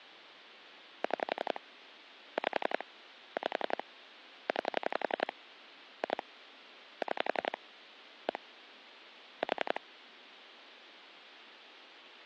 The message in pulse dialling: 6 5 5 9 2 6 1 4

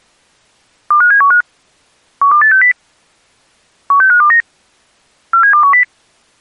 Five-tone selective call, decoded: 25715 12860 16529 47210

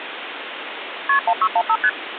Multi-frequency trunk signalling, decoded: KP 1615 ST

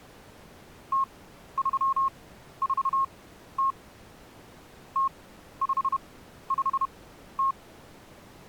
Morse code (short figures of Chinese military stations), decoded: 0340 0550

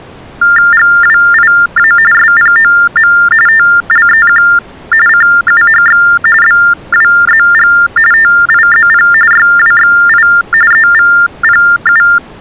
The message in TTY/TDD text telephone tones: GWIA SPOM TLEQ CUHX BWZG TIZP YWXI EVPU

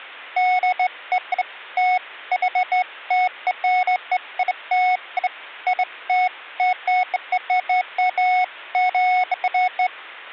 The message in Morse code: none

